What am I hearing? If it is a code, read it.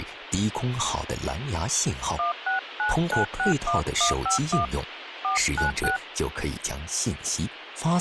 DTMF, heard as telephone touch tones, dialled by hand, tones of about 130 ms, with phone line noise. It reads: 169961151 496